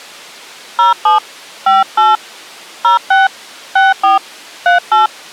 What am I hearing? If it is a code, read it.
DTMF, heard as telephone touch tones, dialled by hand, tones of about 150 ms. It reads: 07 58 06 64 38